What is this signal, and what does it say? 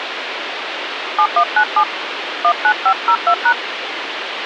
DTMF, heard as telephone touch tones, dialled by hand, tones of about 70 ms, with phone line noise. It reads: 7197 19502#